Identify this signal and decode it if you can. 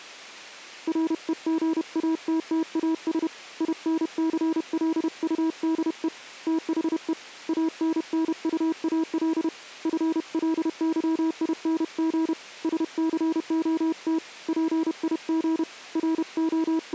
Morse code, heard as a keyed tone, hand-sent with a paddle, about 31 wpm, 320 Hz. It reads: REGATTAS INCLUDE THE ANNUAL FLYING SCOT PIG …